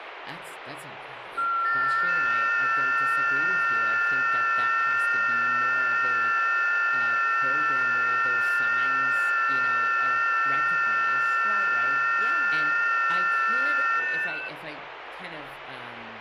FT8 (several signals at once), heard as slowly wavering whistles, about 6.25 baud, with radio static and speech in English.